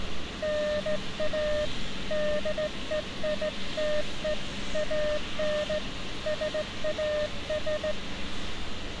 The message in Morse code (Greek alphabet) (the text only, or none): ΝΑ ΔΕΙΤΕ ΑΝ ΣΑΣ